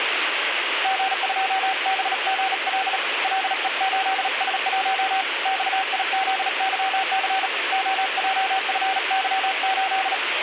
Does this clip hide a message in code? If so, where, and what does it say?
Yes: Morse code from 0.8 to 10.2 s, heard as a keyed tone, hand-sent with a bug key, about 37 wpm, 770 Hz, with radio static. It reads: G2BGL LE8S1 XIZYC OJFY8